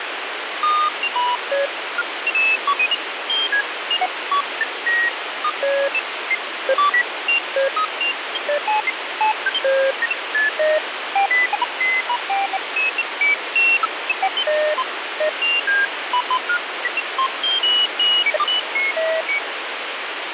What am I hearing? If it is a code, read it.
Electronic bleeps of random pitch and length, with heavy radio static. There is no code.